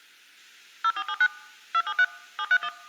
DTMF, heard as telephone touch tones, dialled by machine, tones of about 60 ms. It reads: 0479 273 731